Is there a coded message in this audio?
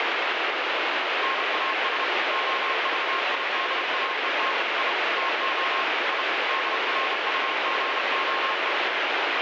Yes: Morse code (Russian alphabet) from 1.2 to 8.8 s, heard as a keyed tone, machine-sent, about 31 wpm, 1070 Hz, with heavy radio static. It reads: НАС ОЖИДАЕТ И ТО И ДРУГОЕ